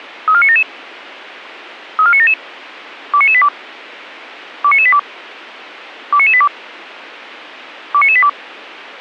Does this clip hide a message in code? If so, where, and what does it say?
Yes: five-tone selective call (ZVEI) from 0.3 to 8.3 s, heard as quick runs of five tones, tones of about 70 ms. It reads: 34977 34977 29982 29982 29982 29982